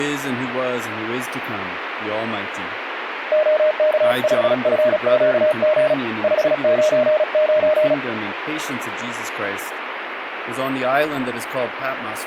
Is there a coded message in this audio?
Yes: Morse code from 3.3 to 8.0 s, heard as a keyed tone, hand-sent with a paddle, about 36 wpm, 610 Hz, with radio static. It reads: OK5FQG 599